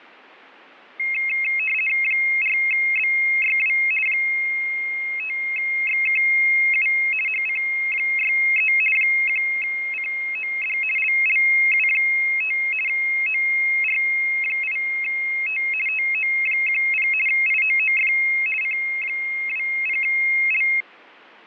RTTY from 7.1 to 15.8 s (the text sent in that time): HC63 1COD LLU5 OR8T